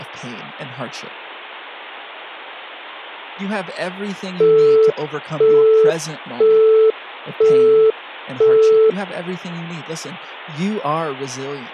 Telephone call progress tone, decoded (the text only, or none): busy tone